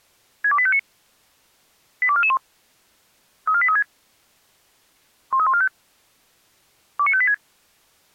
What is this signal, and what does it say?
Five-tone selective call (ZVEI), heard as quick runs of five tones, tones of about 70 ms. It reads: 62859 82441 34836 13145 29586